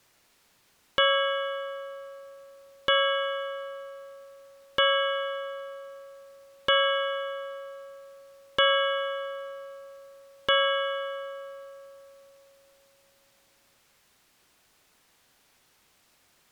Clock strike, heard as a bell. 6. Six o'clock.